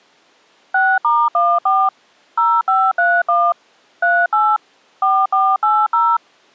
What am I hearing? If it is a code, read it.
DTMF, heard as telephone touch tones, dialled by machine, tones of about 240 ms. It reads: 6*14 0531 38 4480